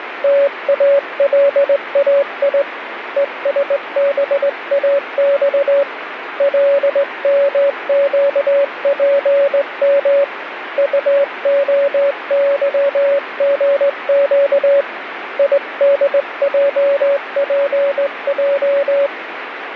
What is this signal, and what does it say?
Morse code, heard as a keyed tone, hand-sent with a straight key, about 19 wpm, 560 Hz, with radio static. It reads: TALAI ESBAX LMQPM UOYGQ IDJPJ